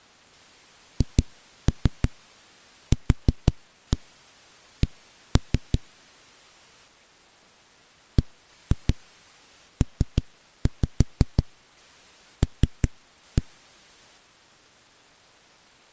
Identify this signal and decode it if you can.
Tap code, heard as knocks on a wall, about 6 knocks a second. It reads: HQC BPL